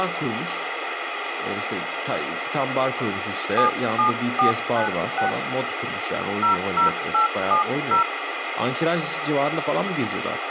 DTMF, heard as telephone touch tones, dialled by hand, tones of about 120 ms, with radio hiss and speech in Turkish. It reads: 77496 00870